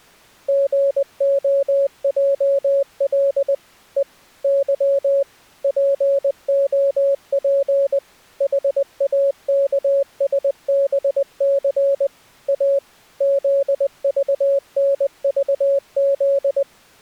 Morse code, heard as a keyed tone, machine-sent, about 20 wpm, 560 Hz. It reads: GOJL E Y POP HAKSBC A ZVNVZ